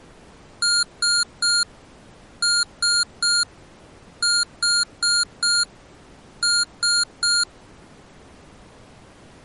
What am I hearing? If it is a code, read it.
Beep code, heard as beeps from a small speaker, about 1410 Hz. 3-3-4-3.